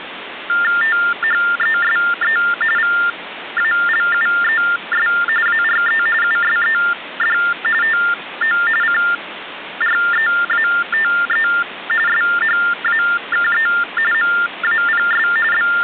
TTY/TDD text telephone tones (45.45 baud Baudot), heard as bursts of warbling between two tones, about 400 Hz shift, 1600 Hz centre, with phone line noise. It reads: THESE VALUES ARE USED TO CREATE SHAKE MAPS …